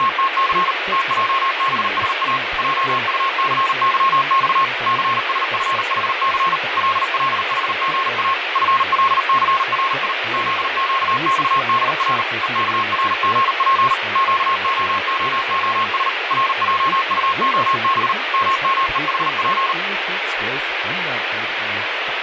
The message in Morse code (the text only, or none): … TJBSA JUCYX CSFHC LLHGA FLCRI ZQXDR EKRGP QOOOS RJUOB MMEHP